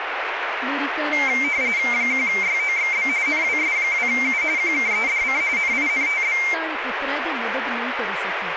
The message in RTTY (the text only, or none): 1YOXB NWS2U QKEDC NINTB